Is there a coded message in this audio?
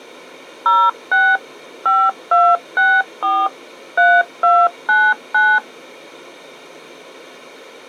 Yes: DTMF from 0.7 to 5.6 s, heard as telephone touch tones, dialled by machine, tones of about 240 ms. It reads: 06 5264 3299